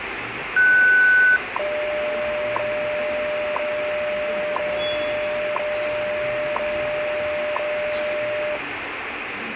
Radio time signal (WWV, Colorado), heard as ticks, one a second, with radio static, room echo and the noise of a subway station.